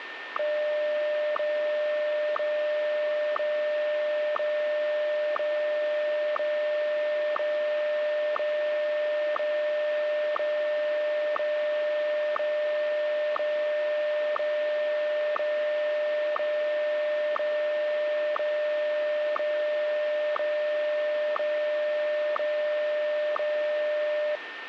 Radio time signal (WWVH, Hawaii), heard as ticks, one a second, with radio static and a steady whistle near 1810 Hz.